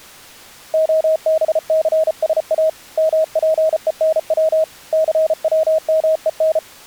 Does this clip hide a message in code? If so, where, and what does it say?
Yes: Morse code (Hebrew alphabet) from 0.7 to 6.6 s, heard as a keyed tone, hand-sent with a paddle, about 34 wpm, 630 Hz. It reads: הבסשא מפונץ סצמון